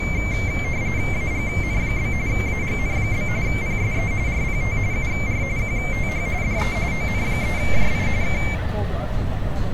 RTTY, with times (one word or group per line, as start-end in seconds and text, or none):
1.1-2.1 AGN?
2.3-3.3 AGN?
3.5-4.1 PSE
4.3-4.8 RPT
4.9-5.4 UR
5.6-6.3 QTH
6.4-6.8 DE
6.9-8.1 ON3JI
8.2-8.4 K